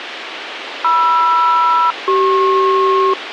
Aircraft SELCAL, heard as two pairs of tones, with radio hiss and a squelch burst at the end. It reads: MR-CP